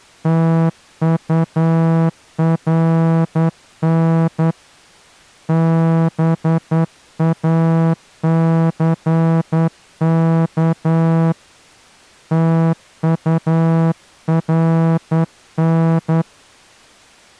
Morse code, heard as a horn, hand-sent with a straight key, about 10 wpm. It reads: TURN BACK TURN